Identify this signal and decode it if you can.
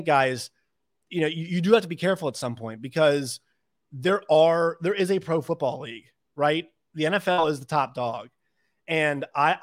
Speech in English. There is no code.